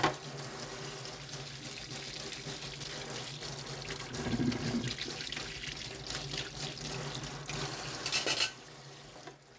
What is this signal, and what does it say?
Kitchen noise. There is no code.